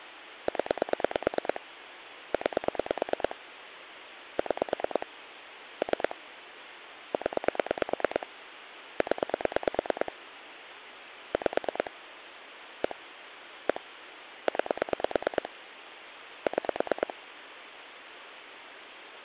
Pulse dialling, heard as clicks on a phone line, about 9 pulses a second, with phone line noise. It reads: 0 9 6 3 0 0 5 1 1 9 6